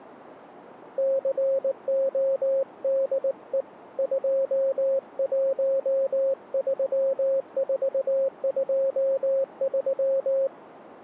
Morse code, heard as a keyed tone, hand-sent with a paddle, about 19 wpm, 540 Hz. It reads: CODE 213423